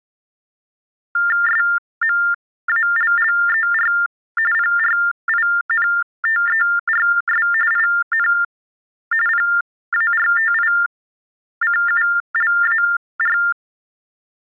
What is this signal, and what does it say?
TTY/TDD text telephone tones (45.45 baud Baudot), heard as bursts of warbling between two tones, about 400 Hz shift, 1600 Hz centre. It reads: SMALLER PRINTERS IN PARTICULAR